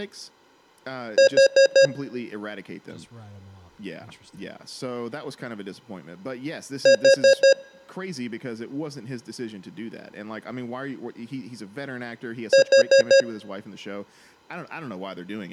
Alarm pattern, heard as an alarm's beeps, played three times, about 540 Hz, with speech in English. Temporal four. Carbon monoxide.